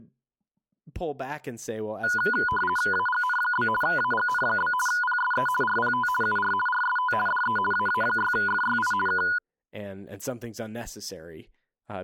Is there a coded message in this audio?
Yes: RTTY (50 baud, 450 Hz shift) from 2.0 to 9.4 s, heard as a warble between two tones, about 1230 Hz centre, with speech in English. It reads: AGN? AGN? PSE RPT UR RST DE AA6FYI K